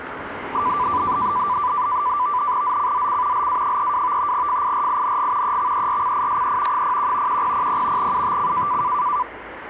NAVTEX (SITOR-B), 100 baud, 170 Hz shift, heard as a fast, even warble, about 1090 Hz centre, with radio static and street noise. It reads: ZCZC LA32 FIRING EXERCISE 01 1000 UTC